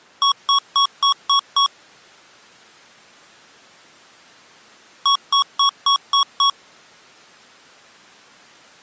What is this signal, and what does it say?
Beep code, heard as beeps from a small speaker, played twice, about 1110 Hz. 6 short. In AMI BIOS tables: keyboard controller gate A20 failure; in Dell tables: video card failure.